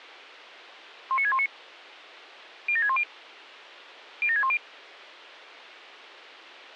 Five-tone selective call (ZVEI), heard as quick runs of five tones, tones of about 70 ms. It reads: 19619 07610 07610